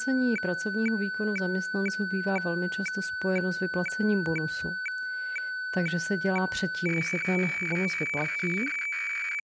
Weather fax (radiofax), 120 lines a minute, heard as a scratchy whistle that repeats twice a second, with speech in Czech.